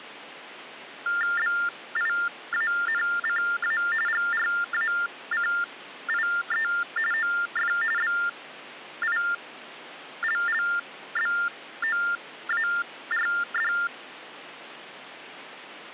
TTY/TDD text telephone tones (45.45 baud Baudot), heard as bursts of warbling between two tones, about 400 Hz shift, 1600 Hz centre. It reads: BIANCA GRACIE OF BILLBOARD